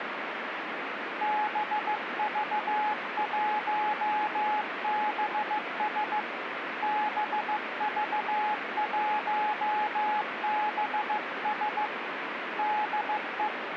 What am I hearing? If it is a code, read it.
Morse code, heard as a keyed tone, hand-sent with a paddle, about 15 wpm, 850 Hz, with radio static. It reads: BV1BS BV1BS DE